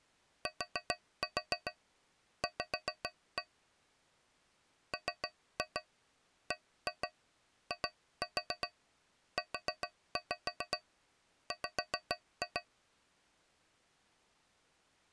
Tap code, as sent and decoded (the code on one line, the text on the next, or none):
4-4 5-1 / 3-2 1-2 2-4 4-5 5-2
TV MBIUW